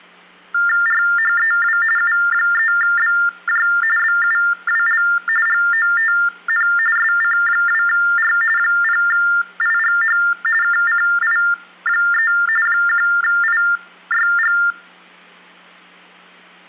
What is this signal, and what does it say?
TTY/TDD text telephone tones (45.45 baud Baudot), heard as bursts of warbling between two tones, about 400 Hz shift, 1600 Hz centre, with hum. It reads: RHEW U3BJ BUWL GOTN SC2R 0IGH KCI3 1IYG